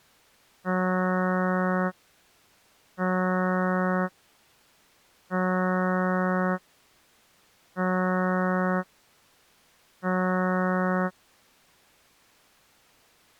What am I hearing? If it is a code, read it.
Ship horn signal, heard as a ship's horn, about 180 Hz. 5 short. At sea: I doubt that you are doing enough to avoid a collision.